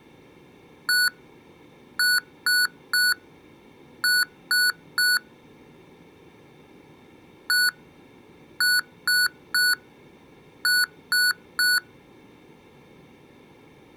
Beep code, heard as beeps from a small speaker, played twice, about 1480 Hz. 1-3-3. In Phoenix BIOS tables: chip or data line failure in the first 64 KB of memory.